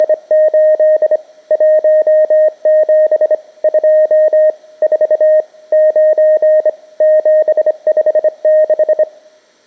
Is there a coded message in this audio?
Yes: Morse code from 0.0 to 9.1 s, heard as a keyed tone, hand-sent with a straight key, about 25 wpm, 620 Hz. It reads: … 17 2 4 9 756